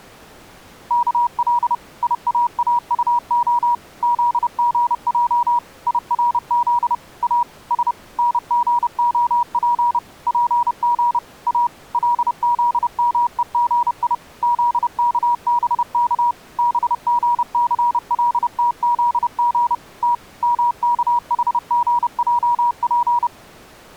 Morse code (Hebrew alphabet), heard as a keyed tone, machine-sent, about 30 wpm, 960 Hz. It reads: כל יאאטה זגע ירז א ש נגהף פג א לזמוגי זכבך בגסלתזג ת מכחגעף